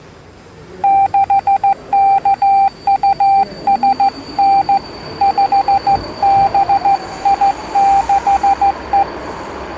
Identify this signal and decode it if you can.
Morse code, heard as a keyed tone, hand-sent with a straight key, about 15 wpm, 790 Hz, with the noise of a subway station. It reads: 6KUSN 5BI6E